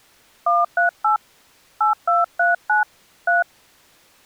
DTMF, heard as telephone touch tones, dialled by hand, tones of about 150 ms. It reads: 138 8239 3